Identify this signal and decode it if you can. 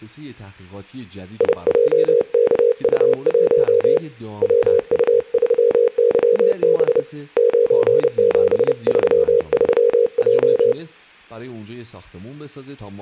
Morse code, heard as a keyed tone, hand-sent with a paddle, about 30 wpm, 470 Hz, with speech in Persian. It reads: IJKU1 WU3YB 9733J